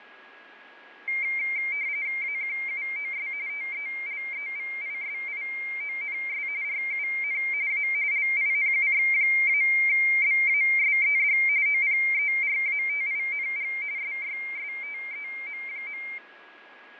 RTTY (45.45 baud, 170 Hz shift), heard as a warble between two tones, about 2200 Hz centre, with radio static, fading and a steady whistle near 1660 Hz. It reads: AQUOS TELEVISIONS RUN A LINUX-BASED OPERATING SYSTEM.